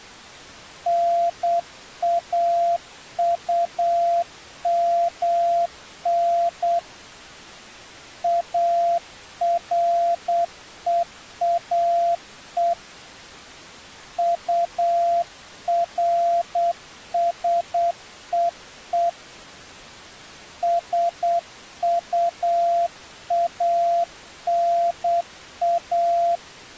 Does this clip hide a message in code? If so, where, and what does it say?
Yes: Morse code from 0.8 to 26.4 s, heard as a keyed tone, hand-sent with a paddle, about 8 wpm, 690 Hz. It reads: NAUMN AREAE URSEE SUANA